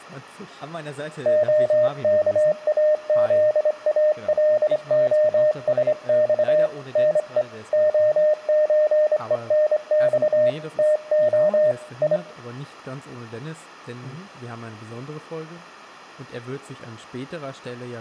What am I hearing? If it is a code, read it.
Morse code (Russian alphabet), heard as a keyed tone, hand-sent with a straight key, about 26 wpm, 610 Hz, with room echo and speech in German. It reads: ОКАЗАЛОСЬ НЕ ОЧЕНЬ ТО И